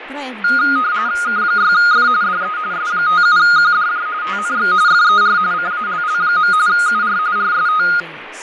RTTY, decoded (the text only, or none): K6F DE S57QDJ TNX FER CALL. UR RST